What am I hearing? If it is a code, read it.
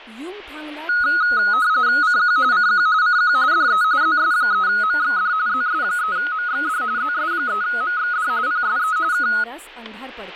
RTTY (45.45 baud, 170 Hz shift), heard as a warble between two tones, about 1360 Hz centre, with speech in Marathi. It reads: CQ CQ CQ DE ZS3MXD ZS3MXD ZS3MXD PSE K